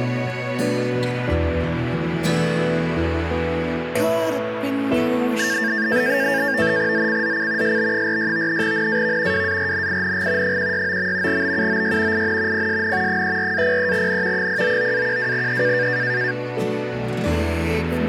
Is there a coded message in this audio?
Yes: NAVTEX (SITOR-B), 100 baud, 170 Hz shift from 5.4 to 16.3 s, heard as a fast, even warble, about 1700 Hz centre. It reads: ZCZC SB46 NAV WARNING 169. BUOY IN PSN 34-03N 099-12E